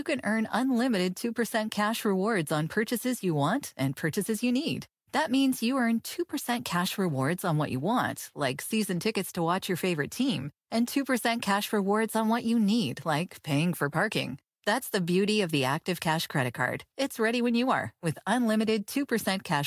Speech in English. There is no code.